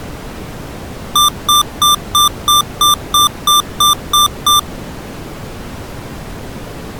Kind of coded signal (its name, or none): beep code